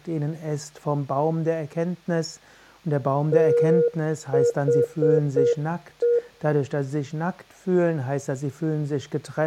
Morse code, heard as a keyed tone, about 7 wpm, 480 Hz, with room echo. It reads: THE